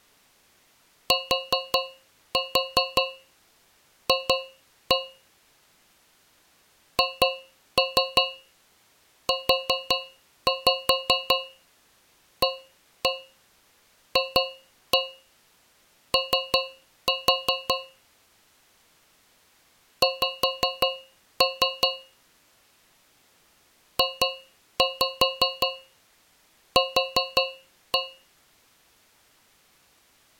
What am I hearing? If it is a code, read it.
Tap code, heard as taps on a metal pipe, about 5 knocks a second. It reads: TF HUAFO X JQ